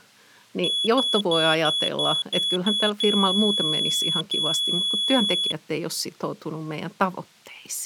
Beep code, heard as a piezo beeper, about 3400 Hz, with speech in Finnish. 7 short, 2 long.